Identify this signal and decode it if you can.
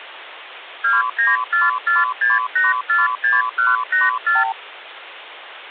Multi-frequency trunk signalling (R2, with the far end's replies), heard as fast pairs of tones, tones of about 170 ms, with phone line noise. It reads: 29446846184